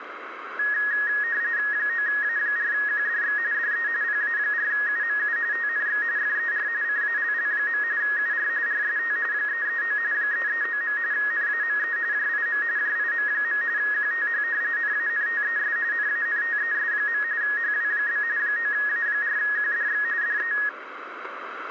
RTTY (45.45 baud, 170 Hz shift), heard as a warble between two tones, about 1750 Hz centre, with radio static. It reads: 9A4QDX DE PA4UMU TNX FER CALL. UR RST 339 339. NAME JIM JIM. QTH NANTES NANTES. HW? 9A4QDX DE